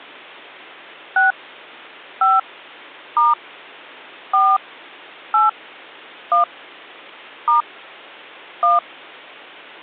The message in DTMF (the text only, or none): 6 5 * 4 8 1 * 1